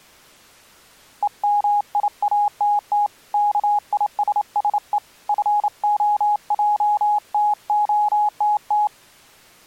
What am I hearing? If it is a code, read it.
Morse code, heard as a keyed tone, hand-sent with a straight key, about 28 wpm, 830 Hz. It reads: EMIATT KISSE FOJTOTT